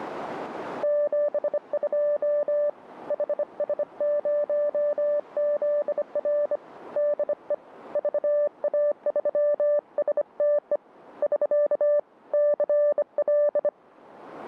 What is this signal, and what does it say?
Morse code, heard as a keyed tone, hand-sent with a bug key, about 25 wpm, 590 Hz. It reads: 72 HS0ZR DE VA3STE <SK> CL